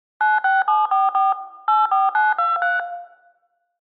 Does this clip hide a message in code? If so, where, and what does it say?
Yes: DTMF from 0.2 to 2.8 s, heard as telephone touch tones, dialled by machine, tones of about 180 ms, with room echo. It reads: 96744 84923